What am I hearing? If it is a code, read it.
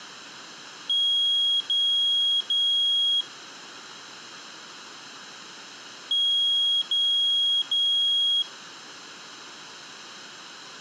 Beep code, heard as a piezo beeper, played twice, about 3300 Hz. 3 long. In IBM BIOS tables: keyboard card error.